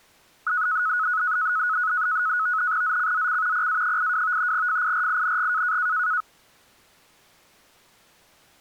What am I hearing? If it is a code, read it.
NAVTEX (SITOR-B), 100 baud, 170 Hz shift, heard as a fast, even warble, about 1370 Hz centre. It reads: ZCZC PA82 FIRING